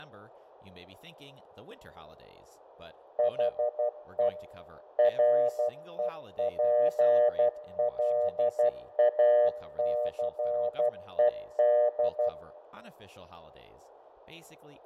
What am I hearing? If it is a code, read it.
Morse code, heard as a keyed tone, machine-sent, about 12 wpm, 600 Hz, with fading, room echo and speech in English. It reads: HE REPLACED